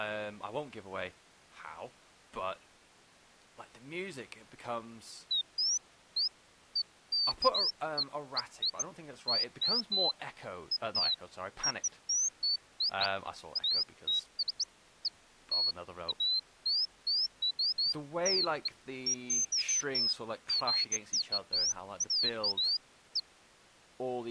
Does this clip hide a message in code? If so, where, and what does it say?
No, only bird-like chirps, with speech in English.